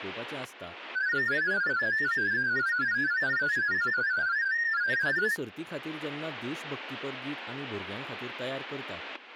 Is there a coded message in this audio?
Yes: multi-tone FSK (Olivia or MFSK type), about 500 Hz wide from 0.9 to 5.4 s, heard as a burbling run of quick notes, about 31.25 baud, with static crashes and speech in Goan Konkani.